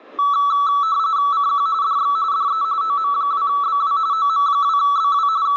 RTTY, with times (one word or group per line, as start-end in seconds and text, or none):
1.3-1.7 CQ
1.8-2.2 DX
2.3-2.6 DE
2.8-4.0 OM2BW
4.1-5.3 OM2BW
5.5-5.6 …